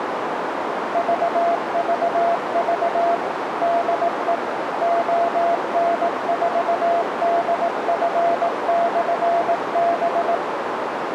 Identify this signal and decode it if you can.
Morse code, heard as a keyed tone, machine-sent, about 18 wpm, 680 Hz, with radio static and a narrow filter. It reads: VVV DE ON4DF/B